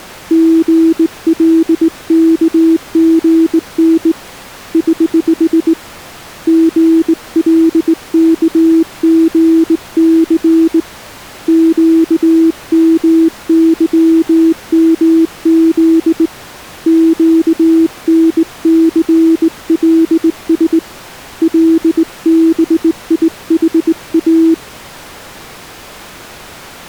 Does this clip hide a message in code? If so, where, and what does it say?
Yes: Morse code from 0.3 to 24.6 s, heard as a keyed tone, hand-sent with a straight key, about 19 wpm, 330 Hz. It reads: GLKGN <HH> GLKGC QMYMZ QNCLS LBIHA